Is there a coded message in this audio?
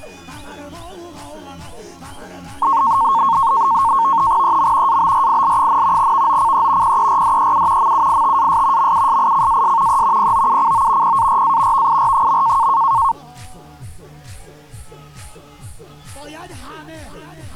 Yes: NAVTEX (SITOR-B), 100 baud, 170 Hz shift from 2.6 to 13.1 s, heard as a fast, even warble, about 1000 Hz centre. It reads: EM ABRIL, VOCE PERDEU MUITAS MUSICAS E POUCO PARA VIR.